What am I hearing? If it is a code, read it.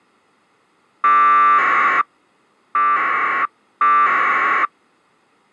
Packet radio (AX.25, as in APRS), 1200 baud, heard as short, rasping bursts.